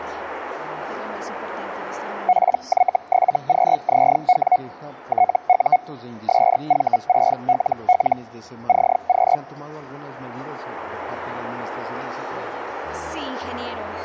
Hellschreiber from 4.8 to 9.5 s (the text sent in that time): TU SV6LL CQ